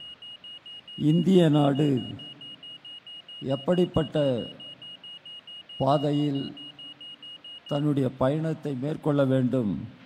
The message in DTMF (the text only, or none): none